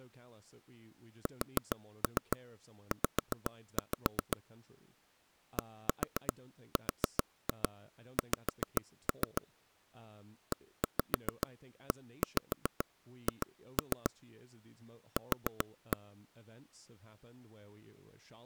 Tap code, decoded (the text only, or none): SZ DRX EEH Q